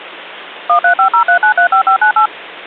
DTMF, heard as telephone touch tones, dialled by machine, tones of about 100 ms. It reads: 13503935598